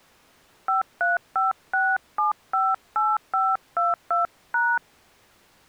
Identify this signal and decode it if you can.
DTMF, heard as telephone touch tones, dialled by hand, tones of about 180 ms. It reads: 5356758522#